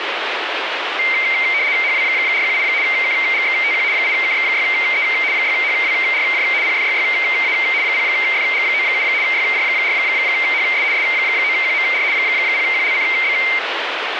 RTTY (75 baud, 170 Hz shift), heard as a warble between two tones, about 2200 Hz centre, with radio static. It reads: HW418 KGXTQ 8KX6E 6HWRJ PFYYA 0FG97 YJ4HS S9QMR 0QLCB